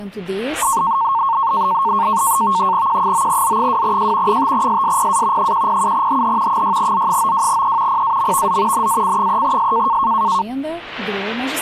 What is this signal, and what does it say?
NAVTEX (SITOR-B), 100 baud, 170 Hz shift, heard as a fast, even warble, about 1000 Hz centre. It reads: Q9Z2J 5SSPA 107HH 6Z92E PAMVZ NAC3S